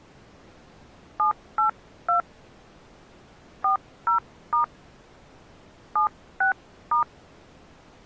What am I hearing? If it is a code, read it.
DTMF, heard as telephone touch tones, dialled by hand, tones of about 120 ms. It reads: 782 40* 76*